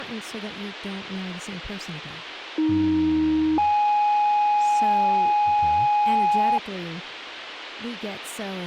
Two-tone page, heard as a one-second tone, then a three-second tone, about 310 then 830 Hz, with radio hiss and speech in English.